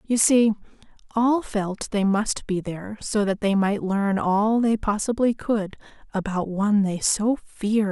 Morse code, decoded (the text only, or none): none